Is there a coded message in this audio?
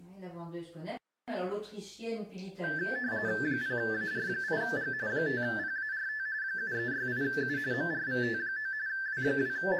Yes: RTTY (45.45 baud, 170 Hz shift) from 2.6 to 9.8 s, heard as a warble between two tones, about 1650 Hz centre. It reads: 0AR8G 5PART 7368U MRVT9 …